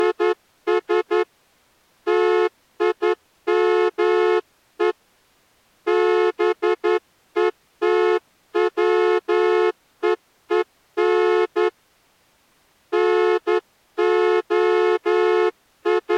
Morse code, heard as a horn, hand-sent with a straight key, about 11 wpm. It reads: … TIME BETWEEN …